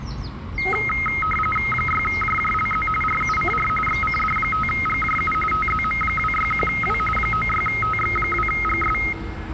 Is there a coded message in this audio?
Yes: RTTY (45.45 baud, 850 Hz shift) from 0.6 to 9.1 s, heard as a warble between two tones, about 1700 Hz centre, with the noise of a residential street. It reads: 6JJLZ RUCR XCD5GJU TZM261W 96TX2GS